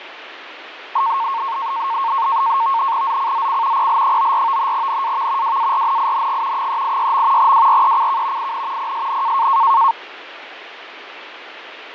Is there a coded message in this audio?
Yes: NAVTEX (SITOR-B), 100 baud, 170 Hz shift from 1.0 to 9.9 s, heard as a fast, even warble, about 1000 Hz centre, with radio static and fading. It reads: ZCZC PL94 NAV WARNING 386. WRECK IN PSN